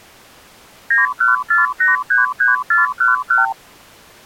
Multi-frequency trunk signalling (R2, with the far end's replies), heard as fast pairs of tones, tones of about 150 ms. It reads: 914833411